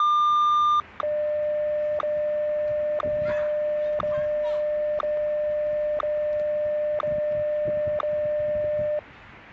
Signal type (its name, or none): radio time signal